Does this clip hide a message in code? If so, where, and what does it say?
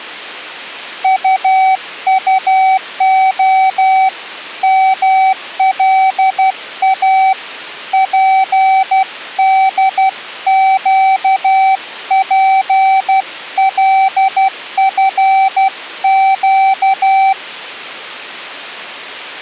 Yes: Morse code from 1.0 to 17.4 s, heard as a keyed tone, hand-sent with a paddle, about 12 wpm, 770 Hz. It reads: UUO MLA PDQPLFQ